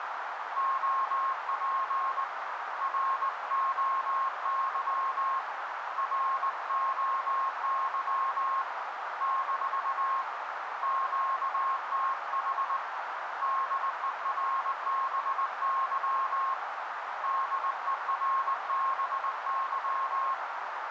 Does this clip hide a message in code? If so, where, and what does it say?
Yes: Morse code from 0.5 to 20.4 s, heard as a keyed tone, hand-sent with a straight key, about 19 wpm, 1070 Hz, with heavy radio static and a narrow filter. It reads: OP ROY ROY - QTH DERBY DERBY